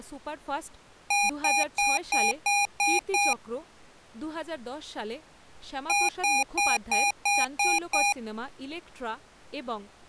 Beep code, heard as beeps from a small speaker, played twice, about 810 Hz, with speech in Bangla. 7 short. In AMI BIOS tables: virtual mode exception error; in Dell tables: processor failure.